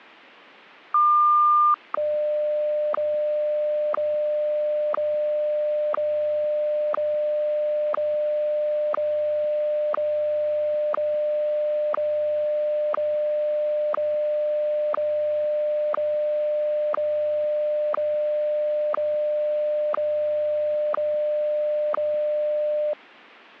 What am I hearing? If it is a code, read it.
Radio time signal (WWVH, Hawaii), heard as ticks, one a second.